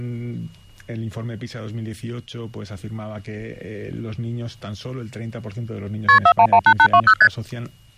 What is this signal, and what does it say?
Multi-frequency trunk signalling (R1, as on North American trunks), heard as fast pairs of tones, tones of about 70 ms. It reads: KP 4118820 ST